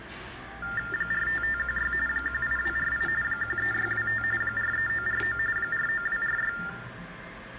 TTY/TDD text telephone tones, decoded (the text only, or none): 45516 18248 13625 43949 49246